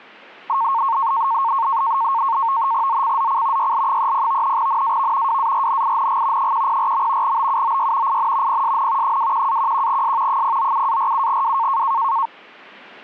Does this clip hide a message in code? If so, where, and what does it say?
Yes: NAVTEX (SITOR-B), 100 baud, 170 Hz shift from 0.5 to 12.3 s, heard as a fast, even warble, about 1000 Hz centre. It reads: ZCZC YL30 NAV WARNING 104. BUOY IN PSN 21-11S 097-47W